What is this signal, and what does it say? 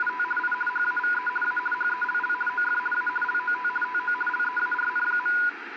RTTY (50 baud, 450 Hz shift), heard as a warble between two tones, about 1220 Hz centre, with radio static. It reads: … I HAVE A HELL OF A LOT TO LEARN.